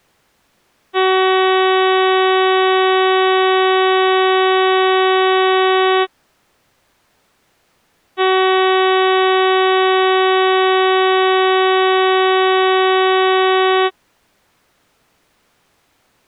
Ship horn signal, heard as a ship's horn, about 380 Hz. 2 long. At sea: a vessel under power that has stopped in fog.